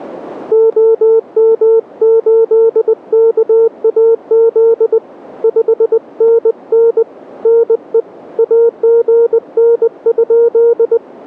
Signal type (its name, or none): Morse code